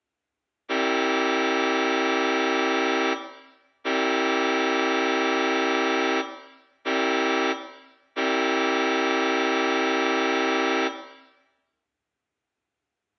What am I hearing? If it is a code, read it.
Train horn signal, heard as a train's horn, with room echo. 2 long, 1 short, 1 long. On North American railways: approaching a public crossing.